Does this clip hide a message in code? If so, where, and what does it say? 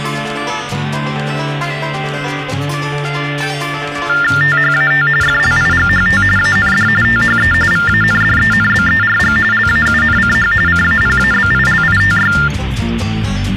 Yes: TTY/TDD text telephone tones (45.45 baud Baudot) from 4.1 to 12.5 s, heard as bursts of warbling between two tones, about 400 Hz shift, 1600 Hz centre, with phone line noise. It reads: THAT FLIGHT AND THE VANDENBERG LAUNCH CAPABILITY